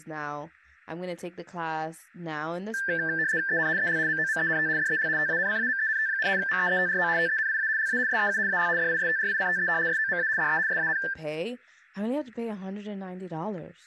RTTY (75 baud, 170 Hz shift), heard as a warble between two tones, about 1650 Hz centre, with static crashes, room echo and speech in English. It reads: EN EL MOMENT DEL TANCAMENT, MEETRO TENIA LA SEU AL DISTRICTE SOMA DE SAN